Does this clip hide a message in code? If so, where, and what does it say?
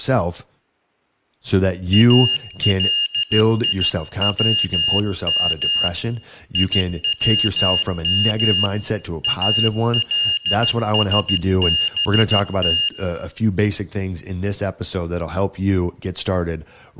Yes: Morse code (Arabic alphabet) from 1.9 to 12.9 s, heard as a high beeper, hand-sent with a paddle, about 14 wpm, 2850 Hz, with speech in English. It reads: اليوم يوم السبت